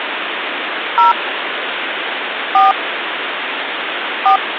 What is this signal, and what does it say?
DTMF, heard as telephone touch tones, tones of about 130 ms, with phone line noise. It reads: 0 4 4